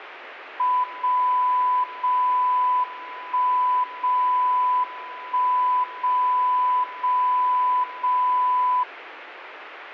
Radio time signal (WWVB), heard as a tone whose level steps once a second, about 1000 Hz. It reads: 0 0 1 0 1 0 0 0